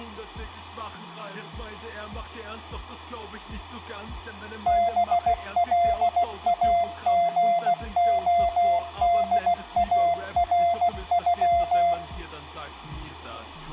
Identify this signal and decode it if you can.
Morse code (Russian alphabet), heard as a keyed tone, machine-sent, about 16 wpm, 690 Hz, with room echo. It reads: БЛАГОДАРЮ